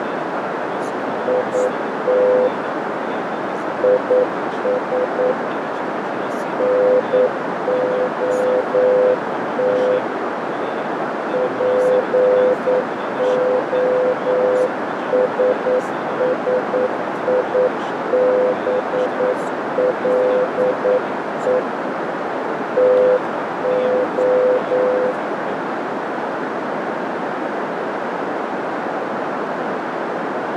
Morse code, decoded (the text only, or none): IT IS NOT POSSIBLE TO